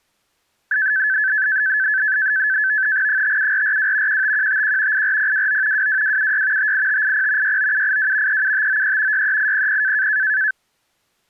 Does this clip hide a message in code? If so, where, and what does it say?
Yes: NAVTEX (SITOR-B), 100 baud, 170 Hz shift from 0.7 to 10.5 s, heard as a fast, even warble, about 1650 Hz centre. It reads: 57442 15151 84029 22276 58580 69782 37593 63800